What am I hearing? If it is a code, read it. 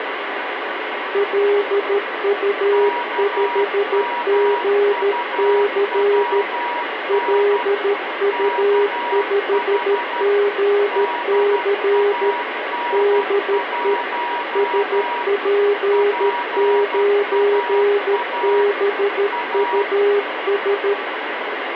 Morse code, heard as two keyed tones, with radio static. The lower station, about 13 wpm, 410 Hz: LU5GC LU5GC DE SP9BUS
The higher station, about 12 wpm, 960 Hz: KMUWN KH DAN1 PAA A